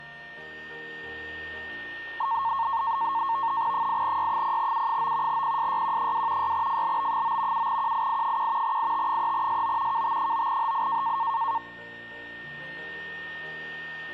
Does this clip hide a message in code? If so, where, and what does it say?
Yes: NAVTEX (SITOR-B), 100 baud, 170 Hz shift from 2.2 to 11.6 s, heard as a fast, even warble, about 1000 Hz centre, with a steady whistle near 1830 Hz. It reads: 8Y0U9 PSYQ2 6FLB9 7QII1 IT3SO KT9HI